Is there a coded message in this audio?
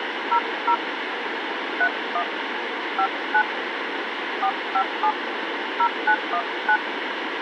Yes: DTMF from 0.3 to 6.8 s, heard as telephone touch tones, dialled by hand, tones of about 80 ms, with radio hiss. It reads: 00 31 59 457 0919